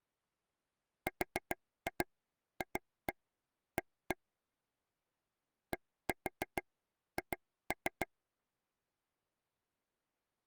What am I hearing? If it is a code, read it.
Tap code, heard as taps on a table, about 7 knocks a second. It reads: RFA DH